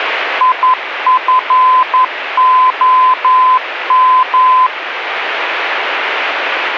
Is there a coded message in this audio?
Yes: Morse code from 0.3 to 4.7 s, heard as a keyed tone, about 11 wpm, 1020 Hz, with radio static. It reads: IFOM